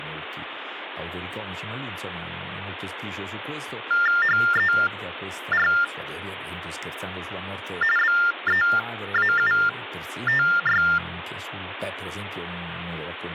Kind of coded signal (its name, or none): TTY/TDD text telephone tones